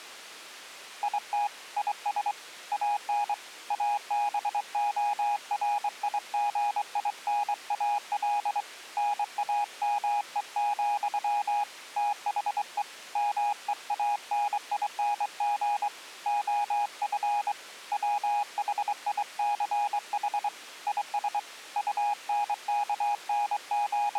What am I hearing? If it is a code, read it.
Morse code, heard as a keyed tone, hand-sent with a straight key, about 23 wpm, 820 Hz. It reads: IT IS AN ABORIGINAL NAME, THE MEANING OF WHICH IS …